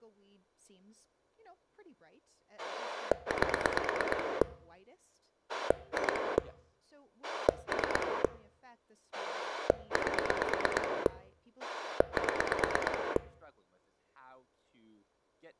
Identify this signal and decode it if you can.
Pulse dialling, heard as a rotary dial, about 9 pulses a second, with speech in English. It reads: 8 2 3 8 7